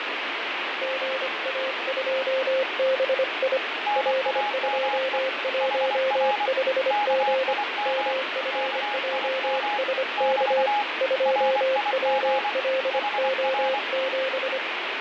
Morse code, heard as two keyed tones, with radio static and fading. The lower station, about 25 wpm, 530 Hz: GA2BI L215G MFJSK 2WLO7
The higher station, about 24 wpm, 830 Hz: NAME HR KIM KIM <BT> RIG HR